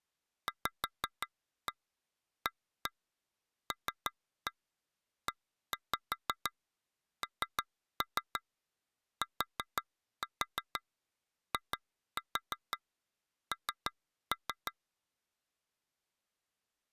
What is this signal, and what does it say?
Tap code, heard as taps on glass, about 6 knocks a second. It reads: VALENTIN